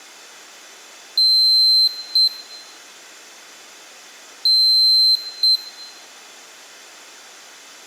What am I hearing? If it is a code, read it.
Beep code, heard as a piezo beeper, played twice, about 4100 Hz, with room echo. 1 long, 1 short. In IBM BIOS tables: system board problem.